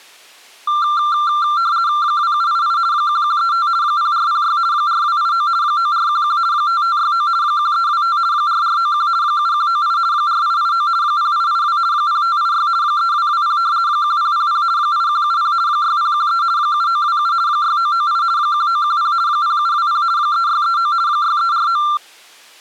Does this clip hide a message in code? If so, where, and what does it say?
Yes: RTTY (50 baud, 170 Hz shift) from 0.7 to 22.0 s, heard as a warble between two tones, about 1280 Hz centre. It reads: 2788 1135 0406 4289 9411 5569 1325 4491 7198 4889 0882 0586 3220 1000 8170 6013 7927 6998 1910 0720 3639 6349